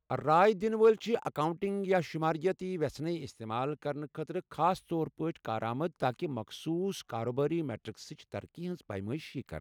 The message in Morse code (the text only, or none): none